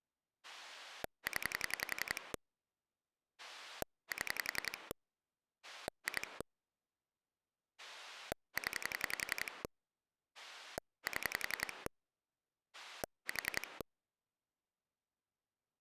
Pulse dialling, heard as a rotary dial, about 11 pulses a second. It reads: 0 7 2 0 7 4